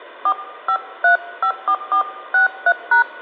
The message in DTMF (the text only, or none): 45354463#